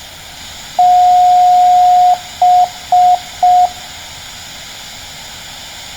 Beep code, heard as beeps, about 720 Hz. 1 long, 3 short. In Award and IBM BIOS tables: video adapter failure; in AMI BIOS tables: memory failure.